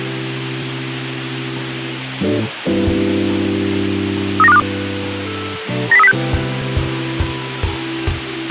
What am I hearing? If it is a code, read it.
Five-tone selective call (EEA), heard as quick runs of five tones, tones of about 40 ms, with radio hiss and a squelch burst at the end. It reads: 39252 90306